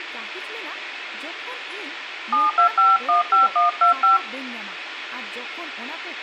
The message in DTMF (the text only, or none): 72515125